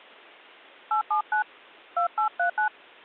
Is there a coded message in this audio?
Yes: DTMF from 0.9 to 2.7 s, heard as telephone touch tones, dialled by hand, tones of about 100 ms. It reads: 879 2839